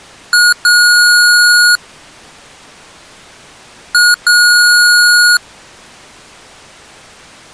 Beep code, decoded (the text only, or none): 1 short, 1 long